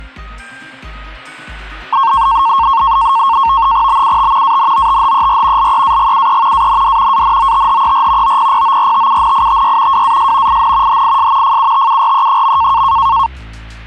NAVTEX (SITOR-B), 100 baud, 170 Hz shift, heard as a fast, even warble, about 1000 Hz centre. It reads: BUT ANOTHER LEAGUE AND ANOTHER OPPORTUNITY WAS IN HIS FUTURE.